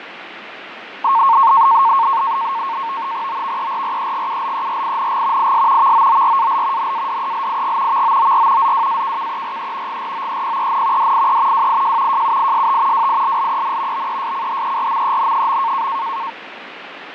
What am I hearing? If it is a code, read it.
NAVTEX (SITOR-B), 100 baud, 170 Hz shift, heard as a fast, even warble, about 1000 Hz centre, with radio static and fading. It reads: OVERREGULERING IS VOORAL NADELIG VOOR ZWAKKERE GROEPEN DIE WIJ JUIST WILLEN BESCHERMEN.